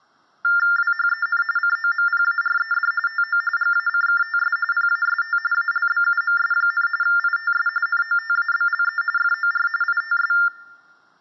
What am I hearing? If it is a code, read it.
TTY/TDD text telephone tones (45.45 baud Baudot), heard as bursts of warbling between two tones, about 400 Hz shift, 1600 Hz centre. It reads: WHEN COMPARED TO GACKTS PAST ALBUMS, ITS NOTABLE FOR ITS